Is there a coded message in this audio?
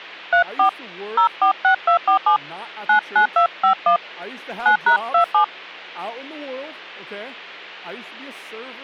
Yes: DTMF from 0.3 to 5.4 s, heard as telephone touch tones, dialled by hand, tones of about 100 ms, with hum and speech in English. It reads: 34 046247 99251 9#27